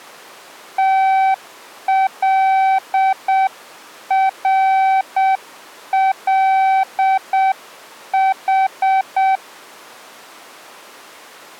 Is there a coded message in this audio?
Yes: Morse code (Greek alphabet) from 0.7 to 9.4 s, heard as a keyed tone, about 7 wpm, 770 Hz. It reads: ΤΛΡΛΗ